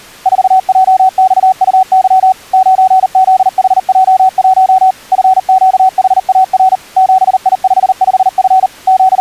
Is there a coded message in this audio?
Yes: Morse code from 0.2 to 9.2 s, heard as a keyed tone, machine-sent, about 39 wpm, 760 Hz. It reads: 4JXUY 9ZHJ1 FQHAR 7I55F …